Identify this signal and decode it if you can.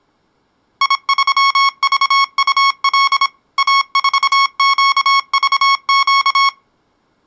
Morse code, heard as electronic beeps, machine-sent, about 26 wpm, 1100 Hz. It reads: I3VUL A4QVQ